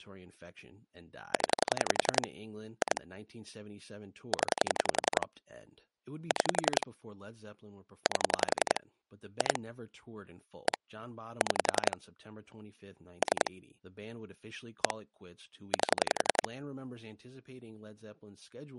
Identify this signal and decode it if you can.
Pulse dialling, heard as clicks on a phone line, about 11 pulses a second, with speech in English. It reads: 0 2 0 6 8 2 1 6 3 1 8